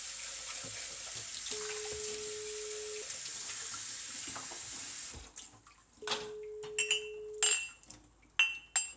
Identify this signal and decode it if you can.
Telephone call progress tone (single-tone plan, as in most of Europe), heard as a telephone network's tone, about 420 Hz, 1.5 s on and 3 s off, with kitchen noise. Ringback tone.